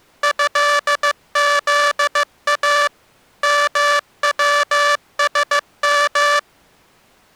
Morse code (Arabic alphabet), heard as a buzzer, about 15 wpm. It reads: هذا موسم